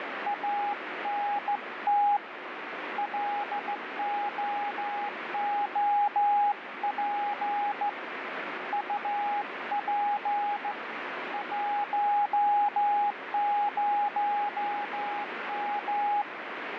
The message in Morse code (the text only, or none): ANT LOOP UP 10M